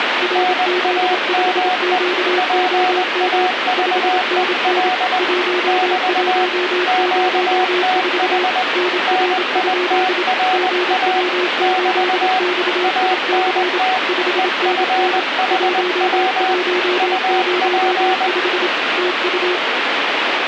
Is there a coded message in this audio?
Yes: Morse code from 0.2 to 19.6 s, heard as two keyed tones, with radio static. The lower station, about 27 wpm, 360 Hz: RZ5QOM 5NN 1104 NR? GW8XIC 5NN 1105 TU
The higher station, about 20 wpm, 740 Hz: NAME PAVEL <BT> QTH NITRA <BT> ANT EFHW UP